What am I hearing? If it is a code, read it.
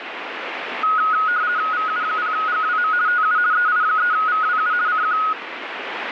RTTY (50 baud, 170 Hz shift), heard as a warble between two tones, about 1360 Hz centre, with radio static. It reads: VU0GWM TU EI3VWU CQ